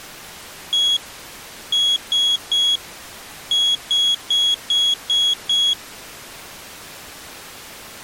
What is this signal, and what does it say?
Beep code, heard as a piezo beeper, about 3350 Hz. 1-3-6.